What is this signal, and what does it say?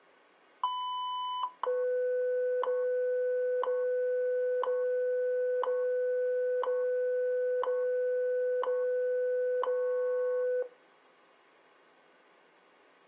Radio time signal (WWV, Colorado), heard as ticks, one a second.